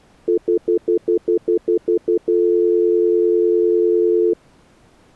Telephone call progress tone (North American plan), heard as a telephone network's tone, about 350, 440 Hz, 0.1 s on and 0.1 s off. Stutter dial tone.